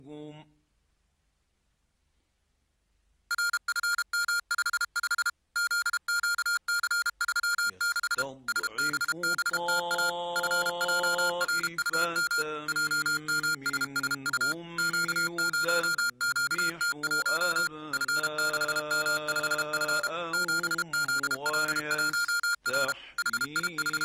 Morse code, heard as electronic beeps, machine-sent, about 32 wpm, 1410 Hz. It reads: RFM55 ZQC36 SBBTA FJRUM JMSSU Q0QT1 F6M5F 7ZL1R …